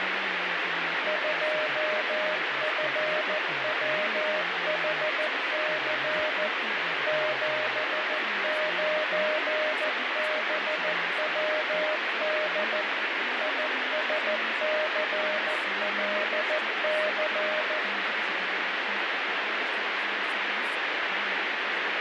Morse code, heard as a keyed tone, machine-sent, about 14 wpm, 620 Hz, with heavy radio static. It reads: 2FWHC 79BWD ISCLC